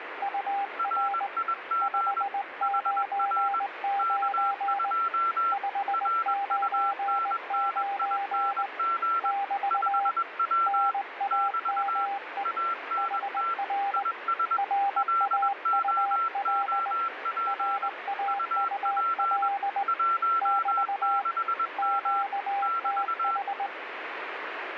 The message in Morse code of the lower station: UR 599 599 <BT> NAME HR RAUL RAUL <BT> QTH

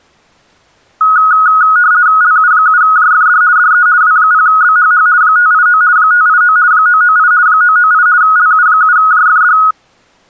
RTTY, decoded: LU7JFD DE W0BHH 589 589 998 998 LU7JFD

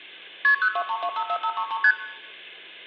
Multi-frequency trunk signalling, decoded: KP 023254533 ST

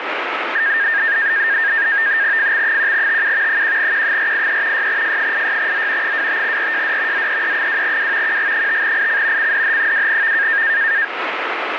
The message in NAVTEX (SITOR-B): FX1TU 1Q483 6F86Z 25RJD ZEE2W QG5IC CDH2V

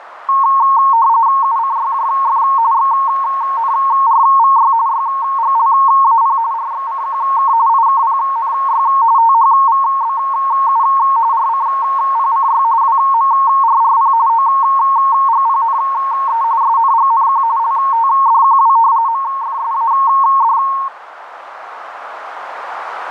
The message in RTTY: UCYJF XNRVY YGLAP RXCQK IKPNY THVBU RCPCY WMRRP OGPNE SNGNQ LTDQW MFSAD

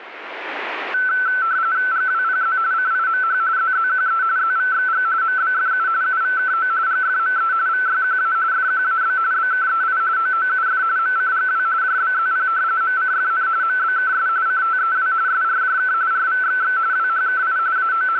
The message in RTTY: GWPZ CIMH ZZQE ZVXG MBFU UVKO GFME VYQA FQAB BKEI OOUF MCGW JBZP MCFN MBKS CTEW SRJK RVXX WHKI …

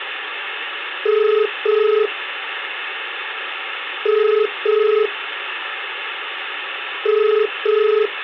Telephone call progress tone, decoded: ringback tone

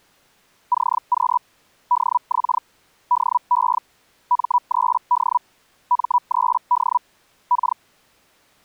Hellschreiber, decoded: CQ DX DE M3D M3D K

